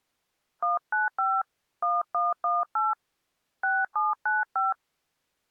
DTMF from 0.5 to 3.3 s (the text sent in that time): 195 1118